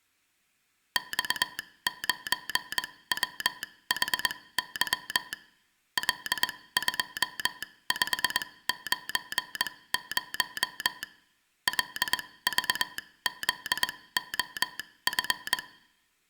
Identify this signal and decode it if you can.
Morse code, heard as a telegraph sounder, machine-sent, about 21 wpm, spaced as for 17 wpm, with room echo. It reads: X9WHY L2590 LVZOF